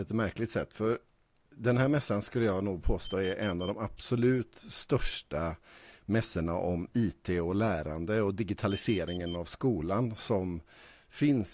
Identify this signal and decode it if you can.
Alarm pattern, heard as an alarm's beeps, played twice, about 3100 Hz, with speech in Swedish. Temporal four. Carbon monoxide.